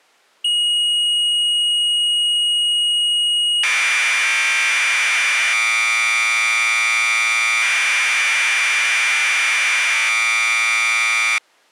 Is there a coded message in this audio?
Yes: Commodore tape loading (standard loader) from 0.4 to 11.4 s, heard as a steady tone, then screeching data.